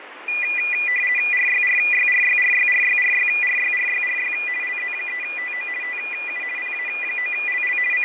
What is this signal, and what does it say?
RTTY (50 baud, 450 Hz shift), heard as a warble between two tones, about 2200 Hz centre, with radio static and fading. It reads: RYRYRYRYRYRYRYRYRY LZ3TO TU PA9LL …